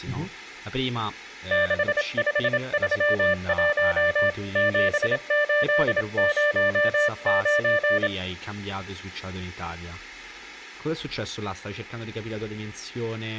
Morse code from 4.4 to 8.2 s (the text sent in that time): 7809